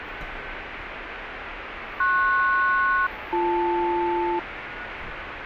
Aircraft SELCAL, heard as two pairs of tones, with radio static and street noise. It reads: PS-BL